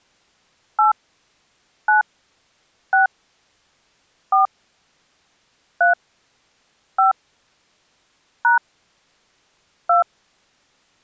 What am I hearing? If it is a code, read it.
DTMF, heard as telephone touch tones, dialled by hand, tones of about 130 ms. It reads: 8 9 6 4 3 5 # 2